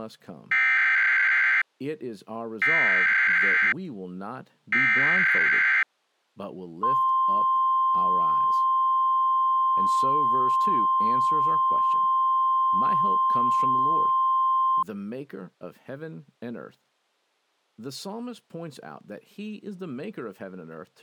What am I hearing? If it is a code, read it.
Emergency Alert System (SAME) tones (header bursts, then the 1050 Hz attention tone), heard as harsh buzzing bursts, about 520.83 baud, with speech in English.